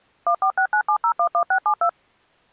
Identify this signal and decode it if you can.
DTMF, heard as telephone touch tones, dialled by machine, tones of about 80 ms. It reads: 14697011672